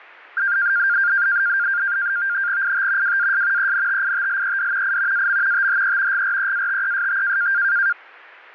NAVTEX (SITOR-B), 100 baud, 170 Hz shift, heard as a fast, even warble, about 1500 Hz centre. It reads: IT WAS ENTITLED I AM THE GREATEST